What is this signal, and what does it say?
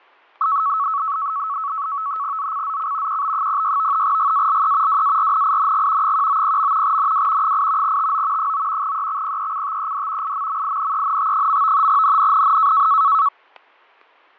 NAVTEX (SITOR-B), 100 baud, 170 Hz shift, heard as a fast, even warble, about 1210 Hz centre, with fading and static crashes. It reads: ZCZC QB06 GALE WARNING 190. NW 8 TO 9 EXPECTED IMMINENT. NNNN